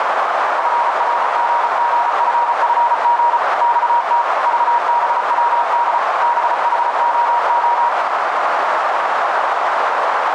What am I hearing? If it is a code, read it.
Morse code, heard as a keyed tone, machine-sent, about 34 wpm, 950 Hz, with heavy radio static and a narrow filter. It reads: FRGGFFG XT VBWD BHOO